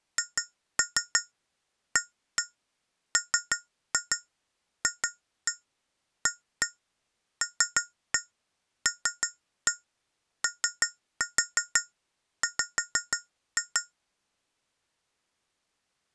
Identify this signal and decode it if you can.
Tap code, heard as taps on glass, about 6 knocks a second. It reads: HAMFALLOW